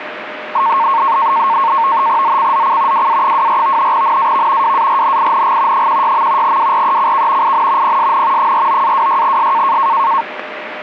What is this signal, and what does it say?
NAVTEX (SITOR-B), 100 baud, 170 Hz shift, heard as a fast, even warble, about 1000 Hz centre, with radio static and a steady whistle near 610 Hz. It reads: ZCZC WA24 NAV WARNING 16. WRECK IN PSN 49-26S